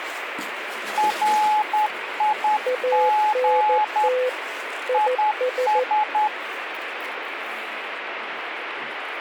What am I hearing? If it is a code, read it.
Morse code, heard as two keyed tones, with radio static and the noise inside a lift. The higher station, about 10 wpm, 850 Hz: RIG IS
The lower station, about 14 wpm, 510 Hz: ANT IS